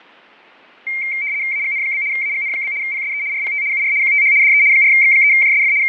RTTY (75 baud, 170 Hz shift), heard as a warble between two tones, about 2200 Hz centre, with fading and static crashes. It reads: AGN? AGN? PSE RPT UR QTH DE 4X3JSF …